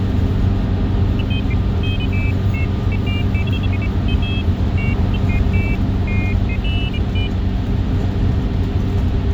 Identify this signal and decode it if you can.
Pairs of high tones at irregular times, with radio hiss and the noise inside a bus. There is no code.